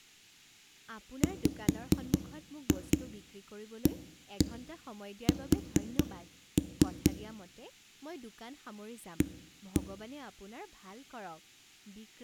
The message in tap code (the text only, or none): WAS A